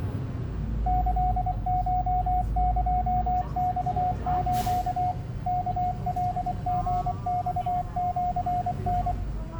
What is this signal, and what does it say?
Morse code (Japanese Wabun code), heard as a keyed tone, machine-sent, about 24 wpm, 720 Hz, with the noise inside a bus. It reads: キコエマス ワカリマシタ